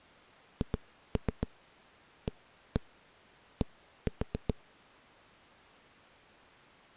Tap code, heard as knocks on a wall, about 7 knocks a second. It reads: HAD